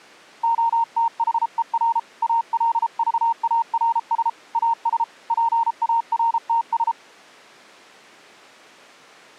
Morse code, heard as a keyed tone, hand-sent with a paddle, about 33 wpm, 920 Hz. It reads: OTHER ALVARS AS PARTS